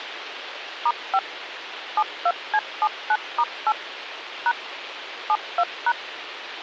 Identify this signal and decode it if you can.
DTMF, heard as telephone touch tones, dialled by machine, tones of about 60 ms, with radio hiss. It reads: *5 72C79*8 # 72#